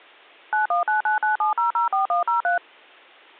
DTMF, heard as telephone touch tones, dialled by machine, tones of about 130 ms. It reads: 919997004103